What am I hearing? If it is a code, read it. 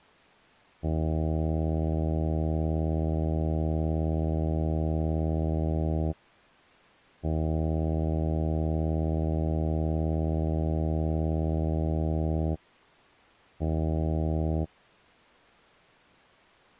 Ship horn signal, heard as a ship's horn, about 80 Hz. 2 long, 1 short. At sea: I intend to overtake on your starboard side.